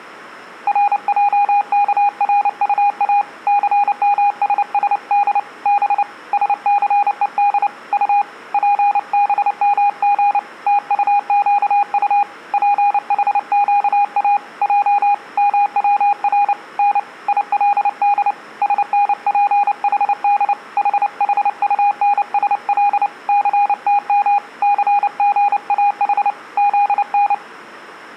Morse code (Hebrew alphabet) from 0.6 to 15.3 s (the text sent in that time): רעכרטא סמששד ב שסוד ט פבמג תטקט פחקא ע